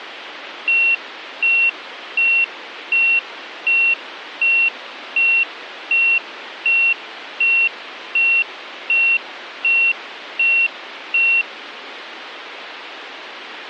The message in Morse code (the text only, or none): none